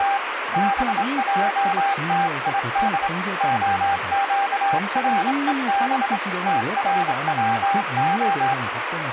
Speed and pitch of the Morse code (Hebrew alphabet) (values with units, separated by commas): 26 wpm, 790 Hz